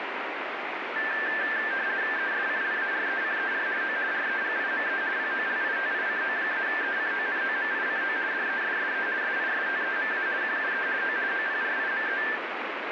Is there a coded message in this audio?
Yes: RTTY (50 baud, 170 Hz shift) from 1.0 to 12.4 s, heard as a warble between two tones, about 1650 Hz centre, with radio static. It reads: ESCLARECER O REGIME POLITICO-ECONOMICO DESSE SISTEMA QUE O OPRIME